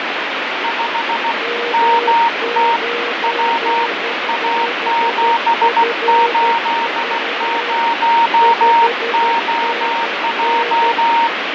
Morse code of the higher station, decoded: 5 MT W A780OJ

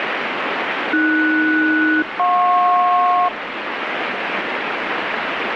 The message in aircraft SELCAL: AS-JP

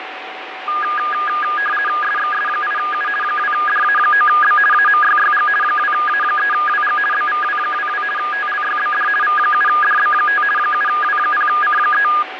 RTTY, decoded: SXS8U 2DA9B AMYYG 2A3WG BVW22 TLYBD V7DB5 7W0C3

